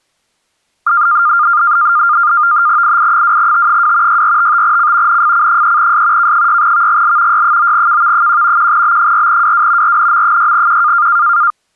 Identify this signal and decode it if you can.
NAVTEX (SITOR-B), 100 baud, 170 Hz shift, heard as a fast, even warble, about 1300 Hz centre. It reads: II2T2 6455C NFC3S K6VGL Y9KV1 1B4WW RNM6Q